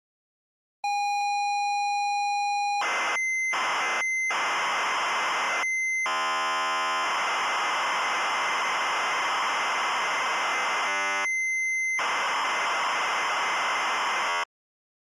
ZX Spectrum tape loading, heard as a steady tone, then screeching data.